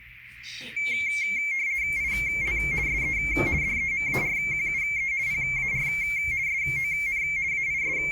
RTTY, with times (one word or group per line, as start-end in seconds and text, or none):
2.0-2.6 IL
2.9-3.2 SE
3.6-5.1 DEMARQUE
5.3-5.9 PAR
6.5-7.2 SON
7.5-8.1 …